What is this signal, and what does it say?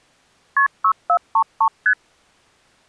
Multi-frequency trunk signalling (R1, as on North American trunks), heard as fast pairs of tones, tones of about 80 ms. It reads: KP 6433 ST